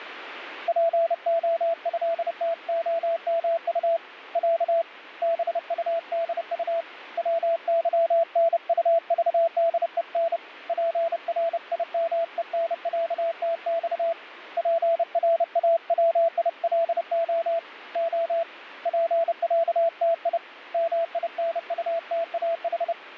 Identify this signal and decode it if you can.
Morse code (Russian alphabet), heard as a keyed tone, hand-sent with a paddle, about 30 wpm, 670 Hz, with radio static. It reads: ПОЭТОМУ Я БУДУ ВЫНУЖДЕН ПРИМЕНЯТЬ ПРАВИЛО О ПЯТИ МИНУТАХ